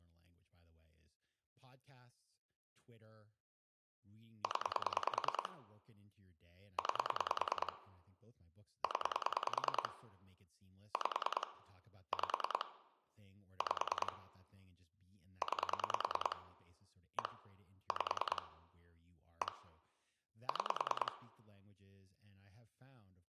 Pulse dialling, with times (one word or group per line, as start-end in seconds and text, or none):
4.4-5.5 0
6.8-7.7 9
8.8-9.9 0
10.9-11.5 5
12.1-12.7 5
13.6-14.1 5
15.4-16.4 9
17.2-17.3 1
17.9-18.4 5
19.4-19.5 1
20.5-21.1 6